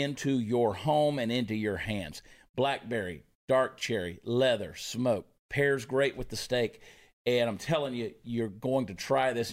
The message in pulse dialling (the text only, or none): none